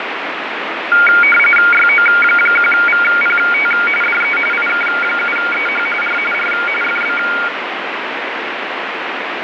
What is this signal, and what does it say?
RTTY (45.45 baud, 850 Hz shift), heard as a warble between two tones, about 1850 Hz centre, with radio static and fading. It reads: YO1VPT DE IK7EH R R FB